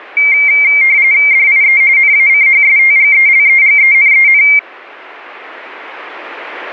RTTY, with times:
1.3-1.8 DIE
2.0-4.4 NACHSTGELEGENEN

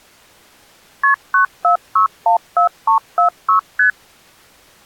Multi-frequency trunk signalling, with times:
1.0-1.1 KP
1.3-3.6 94614346
3.8-3.9 ST

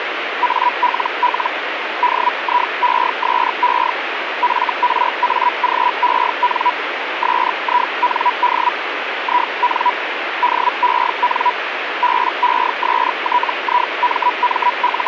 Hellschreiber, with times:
0.4-1.5 ALL
2.0-3.9 DIESE
4.4-6.7 FRAGEN
7.2-8.7 SIND
9.2-9.9 IN
10.4-11.5 DEN
12.0-15.1 …

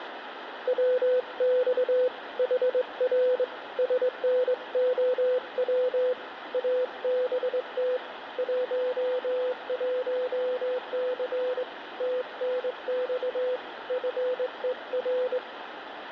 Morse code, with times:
0.7-2.1 WX
2.4-3.4 HR
3.8-6.1 SNOW
6.5-8.0 ABT
8.4-11.6 11C
12.0-13.6 TNX
13.9-15.4 FER

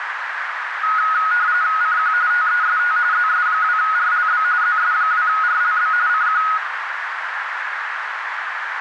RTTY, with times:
1.8-2.1 CQ
2.3-3.0 TEST
3.1-4.4 ZS2RLB
4.6-5.9 ZS2RLB
6.1-6.4 CQ

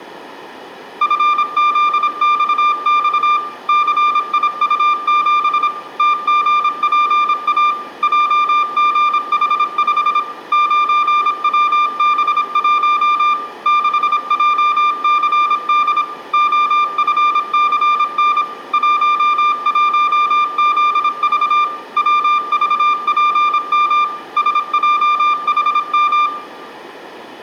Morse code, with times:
1.0-3.4 FZXX
3.7-5.7 CIU7
6.0-7.7 TGPA
8.0-10.2 JGH5
10.5-13.3 9WB1
13.7-16.0 6JCD
16.3-18.4 OFCN
18.7-21.6 11ZV
22.0-24.0 WVPM
24.4-26.3 SJHM

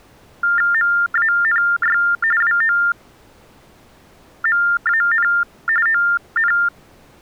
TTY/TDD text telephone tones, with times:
0.7-2.0 MANY
2.4-5.3 WOMAN
5.9-6.5 ON

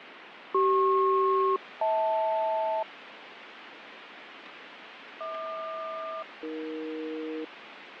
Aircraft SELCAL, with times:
0.5-2.8 CP-HL
5.2-7.4 HQ-AE

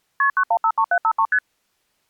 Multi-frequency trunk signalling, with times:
0.2-0.3 KP
0.4-1.3 9153753
1.3-1.4 ST

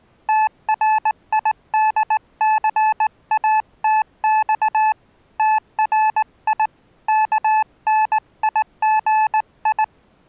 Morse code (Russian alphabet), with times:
0.3-4.9 ТРИДЦАТЬ
5.4-6.7 ТРИ
7.1-9.8 КНИГИ

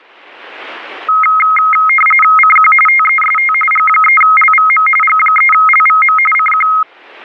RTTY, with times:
2.4-2.7 CQ
2.9-3.5 TEST
3.7-4.9 G3LVM
5.0-6.2 G3LVM
6.3-6.7 CQ

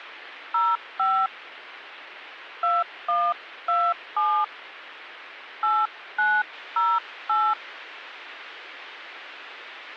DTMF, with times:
0.5-1.3 05
2.6-4.4 2127
5.6-7.5 8908

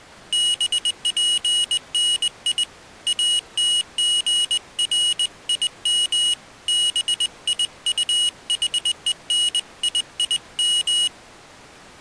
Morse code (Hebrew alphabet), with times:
0.3-2.6 בפני
3.1-6.3 אתגרים
6.7-11.1 ביטחוניים

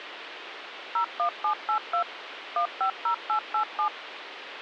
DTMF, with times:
1.0-2.0 01782
2.6-3.9 150887

